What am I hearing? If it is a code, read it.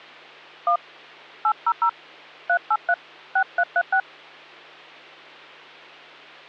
DTMF, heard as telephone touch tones, dialled by hand, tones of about 70 ms, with hum. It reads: 1 800 383 6336